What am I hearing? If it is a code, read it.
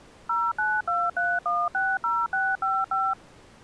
DTMF, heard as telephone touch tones, dialled by machine, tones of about 220 ms. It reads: 0923160655